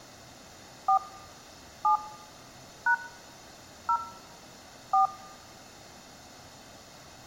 DTMF, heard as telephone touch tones, dialled by hand, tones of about 100 ms. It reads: 4 7 # 0 4